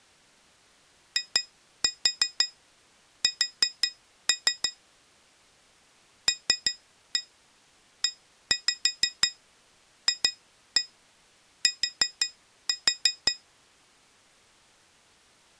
Tap code, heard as taps on glass, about 5 knocks a second. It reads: IS LEFT